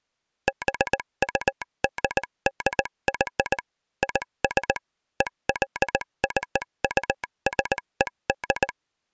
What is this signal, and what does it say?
Morse code (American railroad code), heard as a telegraph sounder, machine-sent. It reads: BUDDY IS EXCUSED